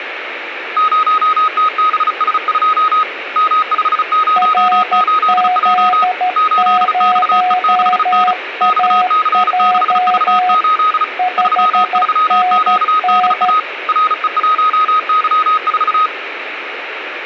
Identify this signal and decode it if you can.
Morse code, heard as two keyed tones, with radio static and room echo. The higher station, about 35 wpm, 1260 Hz: 0TBS2 M508J 8XE6N XC6V8 33QDA RE1Y4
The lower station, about 13 wpm, 730 Hz: RZ0AJ 5NN